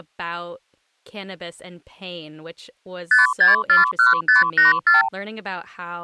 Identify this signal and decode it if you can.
Multi-frequency trunk signalling (R2, with the far end's replies), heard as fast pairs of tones, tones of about 150 ms, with speech in English. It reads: 5641584